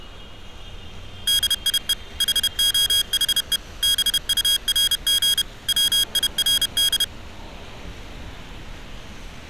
Morse code, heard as electronic beeps, machine-sent, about 31 wpm, 1650 Hz, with street noise. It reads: DIE HOHE BURG WIRD